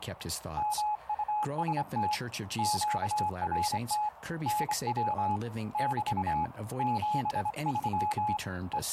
Morse code, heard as a keyed tone, hand-sent with a straight key, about 25 wpm, 840 Hz, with radio static and speech in English. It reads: MUST QRT NW <BT> 73 …